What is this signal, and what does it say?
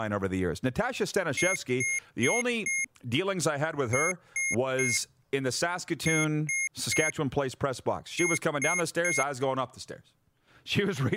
Beep code, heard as beeps from a small speaker, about 2150 Hz, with speech in English. 4-3-3-3.